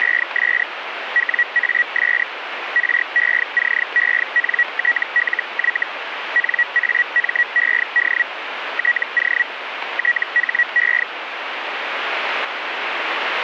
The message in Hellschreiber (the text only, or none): … WAS RECENTLY NAMED TO THE